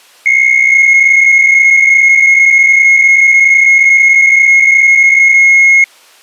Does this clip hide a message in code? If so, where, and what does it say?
Yes: PSK63 (62.5 baud) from 0.3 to 5.8 s, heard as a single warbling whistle, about 2150 Hz.